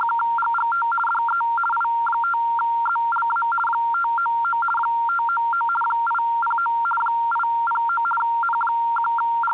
RTTY (50 baud, 450 Hz shift), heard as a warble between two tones, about 1160 Hz centre. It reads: … DE I5ZLA 599 599 809 809 …